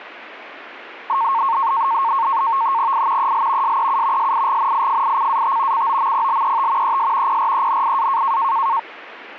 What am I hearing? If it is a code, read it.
NAVTEX (SITOR-B), 100 baud, 170 Hz shift, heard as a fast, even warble, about 1000 Hz centre. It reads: I EL SEU SIGNIFICAT COMPLET ES PRENIA